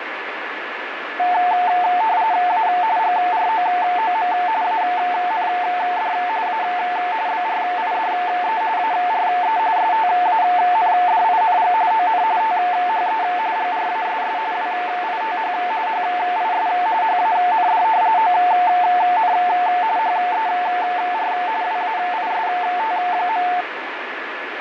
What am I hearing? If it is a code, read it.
RTTY (45.45 baud, 170 Hz shift), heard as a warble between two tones, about 800 Hz centre, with radio static and a steady whistle near 1720 Hz. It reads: A GROOM AND A BRIDE ARE STANDING ON THE GRASS WITH HIS HAND ON HER WAIST.